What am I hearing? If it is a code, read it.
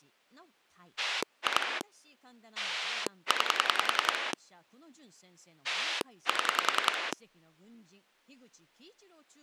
Pulse dialling, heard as a rotary dial, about 10 pulses a second, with speech in Japanese. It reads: 2 9 7